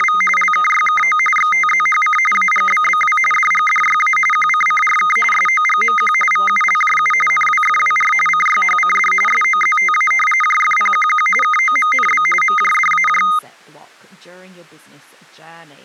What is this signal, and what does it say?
RTTY (45.45 baud, 850 Hz shift), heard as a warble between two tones, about 1650 Hz centre, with speech in English. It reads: … LKYKO XTZHC AGBBW DGDYA QCCRK SOGMQ VULJU NWFWR CYHCD SOZTA JFPQQ KOMNB MJDAJ